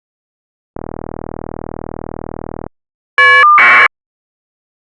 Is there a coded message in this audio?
Yes: caller ID data burst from 0.7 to 3.9 s, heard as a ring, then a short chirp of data, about 1200 baud.